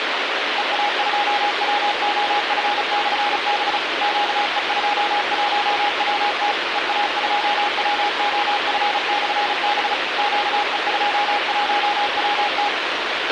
Morse code, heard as a keyed tone, machine-sent, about 35 wpm, 820 Hz, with radio hiss and a squelch burst at the end. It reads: EA2WOF/B QE21WT EA2WOF/B QE21WT